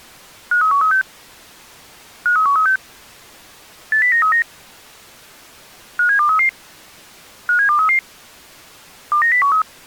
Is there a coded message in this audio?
Yes: five-tone selective call (CCIR) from 0.5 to 9.6 s, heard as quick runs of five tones, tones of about 100 ms. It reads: 53136 53136 80939 57233 57233 29013